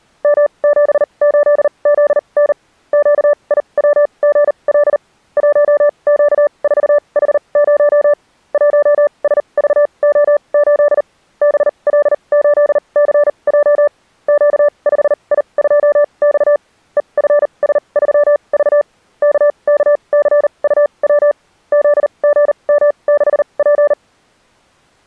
Morse code, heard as a keyed tone, machine-sent, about 39 wpm, spaced as for 29 wpm, 590 Hz. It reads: M78ZN QIWGL 1Q4H0 1SVO8 BL8CJ Q5I2X EFS3V KKCUW ZGM6P